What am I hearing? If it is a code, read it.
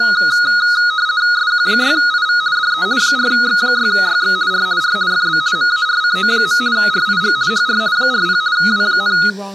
RTTY (50 baud, 170 Hz shift), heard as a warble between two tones, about 1360 Hz centre, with speech in English. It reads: SQ6IV DE 4X6YX R R FB MARCO. RIG HR 40 W,